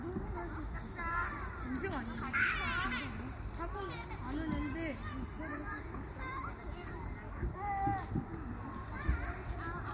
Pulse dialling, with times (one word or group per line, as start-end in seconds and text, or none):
none